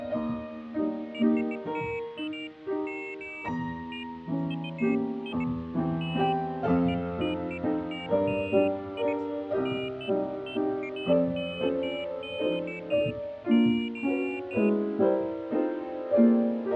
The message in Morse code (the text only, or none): none